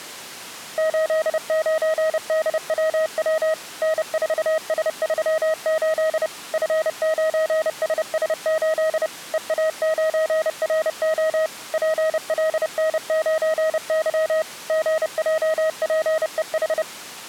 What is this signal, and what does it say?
Morse code, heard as a keyed tone, machine-sent, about 30 wpm, 630 Hz. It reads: 89DWW N4S38 F9SS8 EA9RO PLN9Y GJPEH